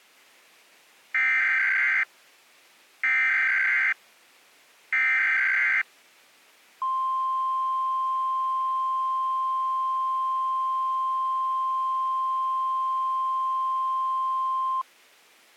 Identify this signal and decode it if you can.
Emergency Alert System (SAME) tones (header bursts, then the 1050 Hz attention tone), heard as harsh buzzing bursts, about 520.83 baud.